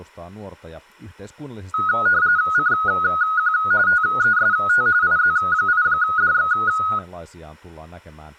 RTTY (45.45 baud, 170 Hz shift), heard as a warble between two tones, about 1360 Hz centre, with speech in Finnish. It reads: CQ TEST IZ8DX